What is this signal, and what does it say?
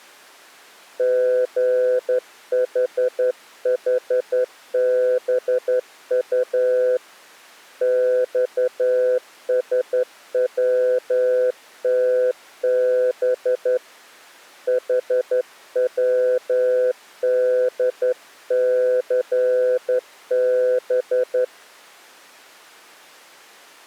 Morse code, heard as a keyed tone, hand-sent with a straight key, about 11 wpm, 500 Hz. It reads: GHHBU XSWTB HWDCB